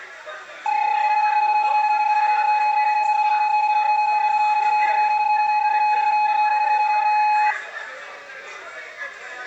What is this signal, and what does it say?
PSK31 (31.25 baud), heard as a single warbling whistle, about 840 Hz, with the noise of a crowd indoors.